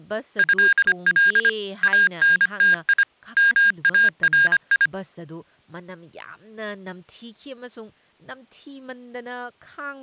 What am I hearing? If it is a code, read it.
Morse code (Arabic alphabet), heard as electronic beeps, machine-sent, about 25 wpm, 1600 Hz, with speech in Manipuri. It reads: هل انتي ماري